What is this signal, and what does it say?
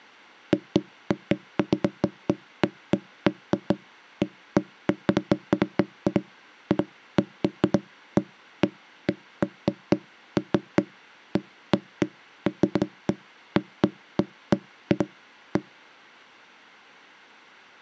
Irregular knocks on wood. There is no code.